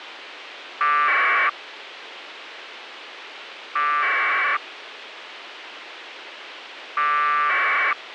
Packet radio (AX.25, as in APRS), 1200 baud, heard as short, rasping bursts, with radio hiss.